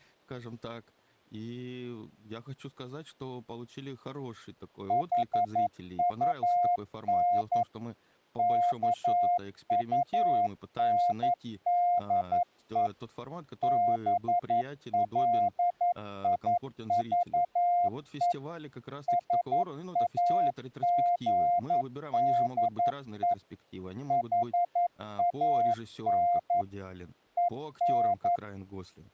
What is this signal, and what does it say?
Morse code, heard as a keyed tone, machine-sent, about 11 wpm, 700 Hz, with speech in Russian. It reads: HUN KUNDE BLIVE SAGDE HAN EN